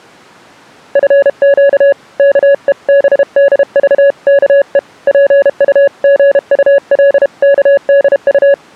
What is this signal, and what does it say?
Morse code (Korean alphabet), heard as a keyed tone, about 32 wpm, 560 Hz. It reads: 내 아들아 지식의